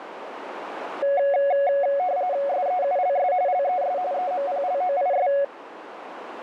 RTTY (45.45 baud, 170 Hz shift), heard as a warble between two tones, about 640 Hz centre, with radio static and a narrow filter. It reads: SEULS LES EMPLOIS